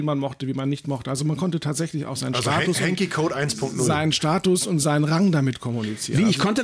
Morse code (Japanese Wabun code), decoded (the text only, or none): none